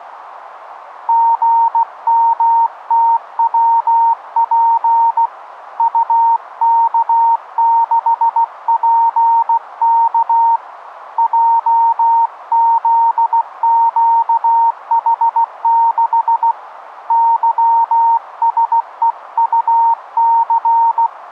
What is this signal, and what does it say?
Morse code, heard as a keyed tone, hand-sent with a paddle, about 16 wpm, 920 Hz, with radio static. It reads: GMTWP UK6PK JZQH6 YSEUC